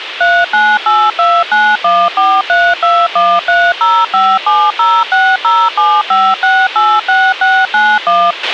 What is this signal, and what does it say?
DTMF, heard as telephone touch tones, dialled by machine, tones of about 240 ms, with radio hiss and a squelch burst at the end. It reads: 3982914321305706075686691